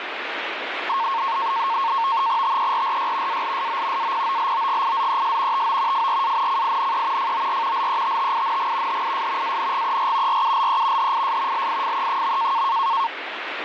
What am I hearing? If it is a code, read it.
NAVTEX (SITOR-B), 100 baud, 170 Hz shift, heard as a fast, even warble, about 1000 Hz centre, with radio static. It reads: TERRY ALSO APOLOGIZES TO FRANCINE FOR LETTING HIS ANGER RULE HIS LIFE.